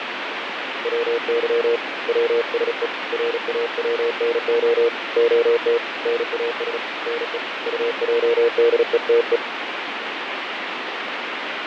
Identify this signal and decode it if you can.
Morse code (Russian alphabet), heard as a keyed tone, hand-sent with a paddle, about 36 wpm, 470 Hz, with radio static and fading. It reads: ВЫ ВСЕ РАВНО ОТ НАС НЕ УЙДЕТЕ